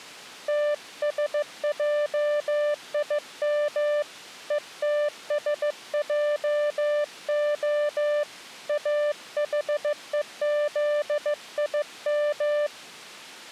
Morse code (Hebrew alphabet), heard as a keyed tone, hand-sent with a paddle, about 15 wpm, 590 Hz. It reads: תשעים ותשעה אחוזים